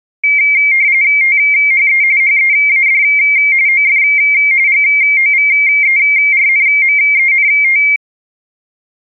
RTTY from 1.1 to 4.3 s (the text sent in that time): THE HEAD OF